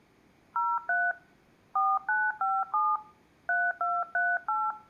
DTMF, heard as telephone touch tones, dialled by hand, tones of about 220 ms. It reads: 03 4957 3238